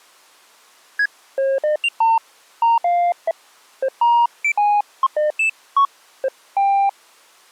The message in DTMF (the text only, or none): none